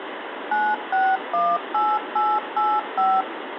DTMF, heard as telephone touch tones, dialled by machine, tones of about 230 ms, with phone line noise. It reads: 9618885